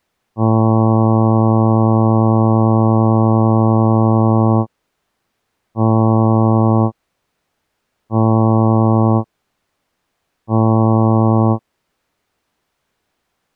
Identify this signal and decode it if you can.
Ship horn signal, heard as a ship's horn, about 110 Hz. 1 long, 3 short. At sea: a vessel under tow in fog.